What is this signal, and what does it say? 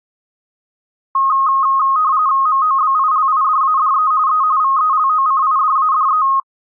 RTTY (45.45 baud, 170 Hz shift), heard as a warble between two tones, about 1170 Hz centre. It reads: MOBILIDADE E VELOCIDADE